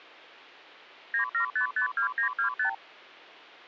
Multi-frequency trunk signalling (R2, with the far end's replies), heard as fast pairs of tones, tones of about 100 ms. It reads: 97552925